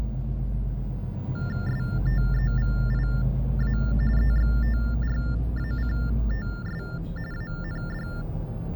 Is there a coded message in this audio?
Yes: TTY/TDD text telephone tones (45.45 baud Baudot) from 1.3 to 8.2 s, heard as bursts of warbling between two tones, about 400 Hz shift, 1600 Hz centre, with the noise inside a bus. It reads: STEVIA EXTRACTS AND